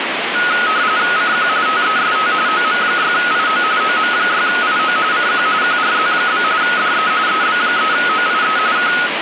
RTTY (45.45 baud, 170 Hz shift), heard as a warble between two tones, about 1360 Hz centre, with radio static. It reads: CQ TEST OM6IO OM6IO CQ QRZ? DE EB3OIE K